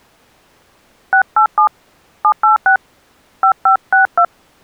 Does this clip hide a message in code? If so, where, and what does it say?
Yes: DTMF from 1.1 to 4.2 s, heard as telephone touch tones, dialled by hand, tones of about 110 ms. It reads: 687 786 5562